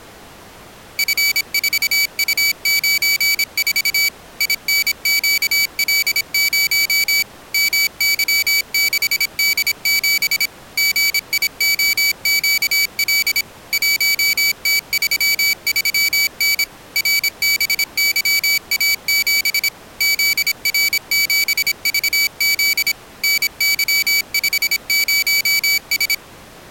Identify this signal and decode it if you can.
Morse code, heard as a high beeper, machine-sent, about 26 wpm, 2300 Hz. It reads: F4U94 INQL0 MY6D7 GIOQL 1T33N RBYA7 ZR7VZ NY50S